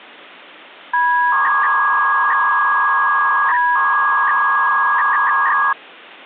300-baud modem data (V.21 tones), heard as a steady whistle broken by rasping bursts, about 300 baud, 200 Hz shift.